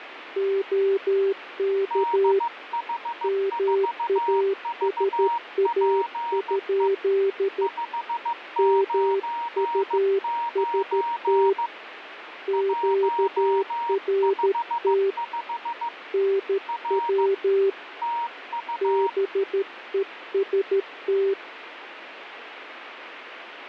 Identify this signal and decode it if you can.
Morse code, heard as two keyed tones, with radio static. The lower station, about 13 wpm, 390 Hz: OK MASA? MUST QRT NW BEST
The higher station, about 15 wpm, 940 Hz: DH4VPE 599 155 R TU